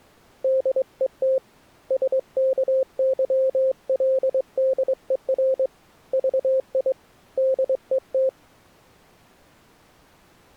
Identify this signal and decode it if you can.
Morse code, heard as a keyed tone, hand-sent with a straight key, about 23 wpm, 530 Hz. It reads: DET SKYLDER VI DET